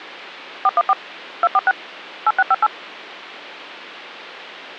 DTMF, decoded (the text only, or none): 414 246 8658